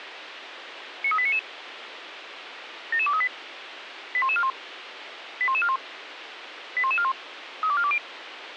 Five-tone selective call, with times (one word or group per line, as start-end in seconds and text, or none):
1.0-1.4 93899
2.9-3.3 77238
4.1-4.5 81141
5.4-5.8 81141
6.8-7.1 81141
7.6-8.0 32420